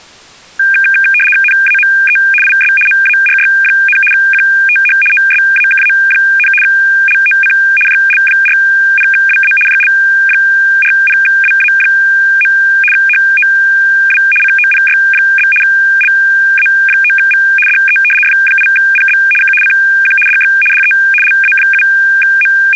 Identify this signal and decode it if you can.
RTTY (75 baud, 850 Hz shift), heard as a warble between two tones, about 2000 Hz centre. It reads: NAME IS MARY, QTH OSAKA, LOC JL40WA JL40WA. HOW COPY? LA9V DE F8PB K CQ DX DE …